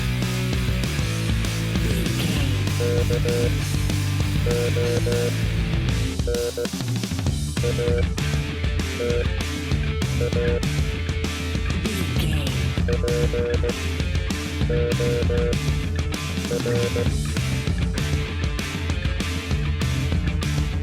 Morse code, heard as a keyed tone, machine-sent, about 16 wpm, spaced as for 7 wpm, 480 Hz. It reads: KONATA POR